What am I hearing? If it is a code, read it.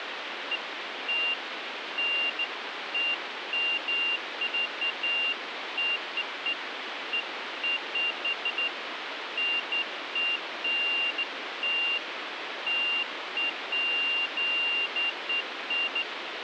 Beeps of irregular length, with phone line noise. There is no code.